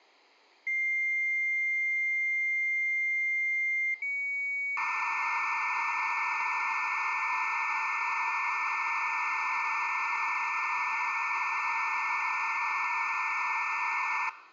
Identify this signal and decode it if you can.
Dial-up modem handshake (low-speed, two carriers), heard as two whistles, then hiss.